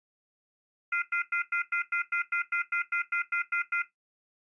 Telephone call progress tone (North American plan), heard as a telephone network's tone, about 1400, 2050, 2450, 2600 Hz, 0.1 s on and 0.1 s off. Off-hook warning tone.